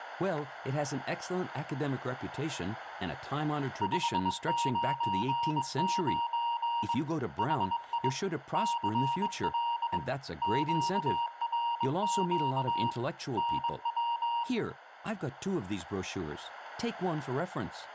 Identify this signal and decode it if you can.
Morse code, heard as a keyed tone, hand-sent with a straight key, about 22 wpm, 940 Hz, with room echo and speech in English. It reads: 599 HI CL QRQ NW